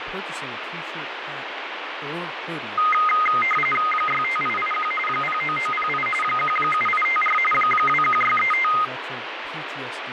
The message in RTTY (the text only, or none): 65881 09908 17854 21635